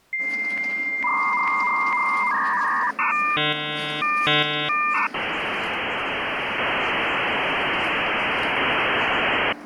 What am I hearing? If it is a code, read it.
Dial-up modem handshake (V.34 or later), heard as a whistle, warbles, then hiss, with the noise inside a bus.